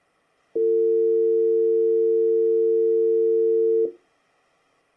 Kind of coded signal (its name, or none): telephone call progress tone